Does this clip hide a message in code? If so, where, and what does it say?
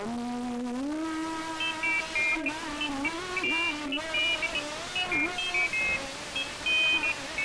No, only pairs of high tones at irregular times, with room echo.